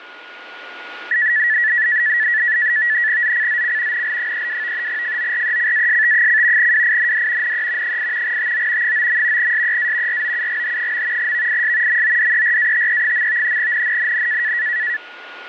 NAVTEX (SITOR-B), 100 baud, 170 Hz shift, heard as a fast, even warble, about 1850 Hz centre, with radio static and a steady whistle near 1440 Hz. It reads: ZCZC NL32 FORECAST: WIND NE 8 TO 9. SEA ROUGH. VIS MODERATE. NNNN